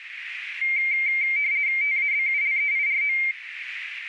RTTY (50 baud, 170 Hz shift), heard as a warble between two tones, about 2200 Hz centre, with radio static and a narrow filter. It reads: TABULEIRO